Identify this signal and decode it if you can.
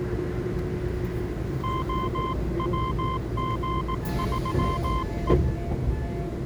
Morse code, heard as a keyed tone, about 18 wpm, 1040 Hz, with the noise inside a subway train. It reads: OWG3E